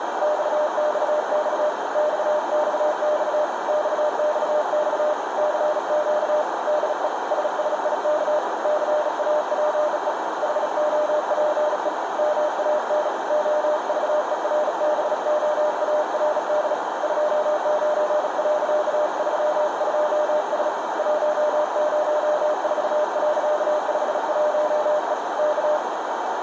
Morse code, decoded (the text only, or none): XXX XXX XXX CQ DE SSIK CAPE HOPE MAN OVERBOARD 29.32S 104.51E K